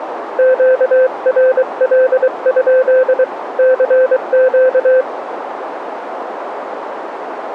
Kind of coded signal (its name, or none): Morse code